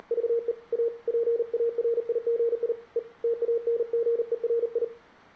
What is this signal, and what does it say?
Morse code, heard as a keyed tone, hand-sent with a paddle, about 39 wpm, 470 Hz, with room echo. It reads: … A PARIGI E TANGERI